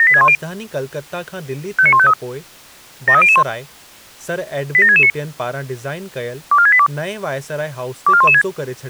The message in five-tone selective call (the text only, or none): 78610 59153 73001 87669 24682 24116